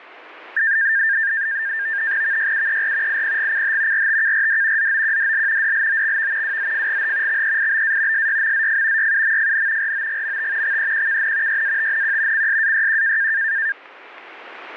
NAVTEX (SITOR-B), 100 baud, 170 Hz shift, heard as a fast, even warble, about 1700 Hz centre. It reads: VYUER IPGCH RTKRD ZOQDL DLOXV WZFGH XEIBA SYMZF YUMFN ROGMT XEQKN YATNQ CSAYQ